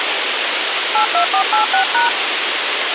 DTMF, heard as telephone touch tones, dialled by hand, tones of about 120 ms, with radio hiss. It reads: 82486#